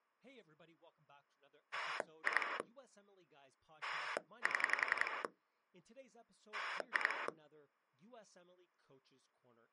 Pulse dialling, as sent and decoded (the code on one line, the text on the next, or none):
2 / 7 / 2
2 7 2